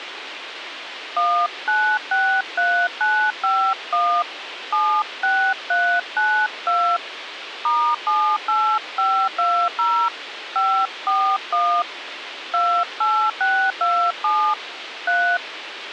DTMF, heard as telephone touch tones, dialled by hand, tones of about 300 ms, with radio hiss. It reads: 1963951 76392 *78520 541 28627 3